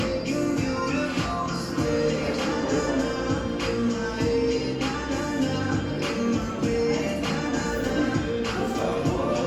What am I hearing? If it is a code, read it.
The noise of a cafe. There is no code.